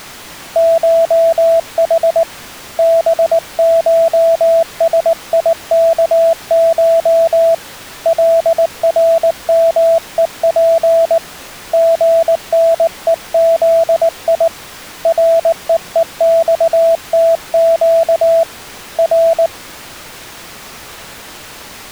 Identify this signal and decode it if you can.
Morse code (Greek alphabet), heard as a keyed tone, hand-sent with a paddle, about 19 wpm, 660 Hz. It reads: ΧΗ ΒΧΣΙΚΧ ΛΡΜΕΠ ΓΝΕΖΙ ΡΕΕΞΤΨ Ρ